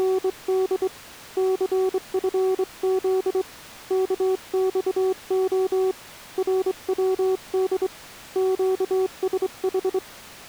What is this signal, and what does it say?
Morse code, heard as a keyed tone, hand-sent with a straight key, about 25 wpm, 380 Hz. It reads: … CFZ KXO RWD QSH